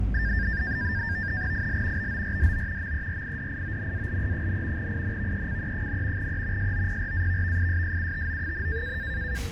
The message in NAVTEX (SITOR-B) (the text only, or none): IL BORDO MERIDIONALE, INVECE, E SOPRAVVISSUTO,